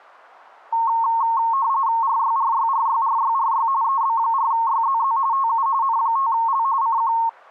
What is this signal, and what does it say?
RTTY (45.45 baud, 170 Hz shift), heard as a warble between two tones, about 1000 Hz centre. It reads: RYRYRYRYRY EB4YZZ TU N5L CQ